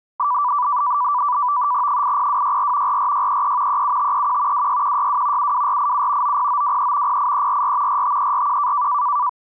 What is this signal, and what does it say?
NAVTEX (SITOR-B), 100 baud, 170 Hz shift, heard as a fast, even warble, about 1080 Hz centre. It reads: 80264 44633 37531 26162 72487 90923 08344 45341